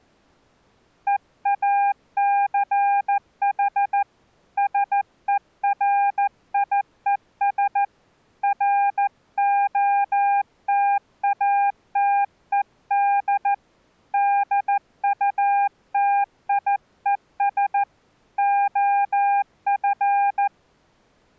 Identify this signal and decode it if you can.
Morse code, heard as a keyed tone, hand-sent with a paddle, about 14 wpm, 800 Hz. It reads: EACH SERIES ROTATED DUTIES OF